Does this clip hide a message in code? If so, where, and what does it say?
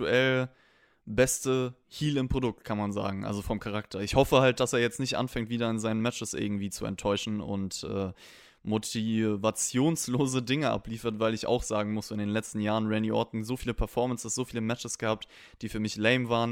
No, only speech in German.